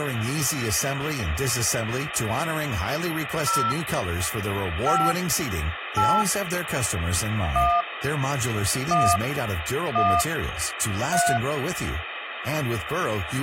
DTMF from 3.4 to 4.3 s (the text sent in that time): 0